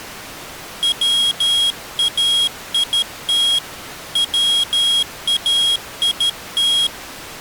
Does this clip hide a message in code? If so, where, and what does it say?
Yes: Morse code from 0.8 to 6.9 s, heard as a high beeper, hand-sent with a paddle, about 13 wpm, 3300 Hz. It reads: WAIT WAIT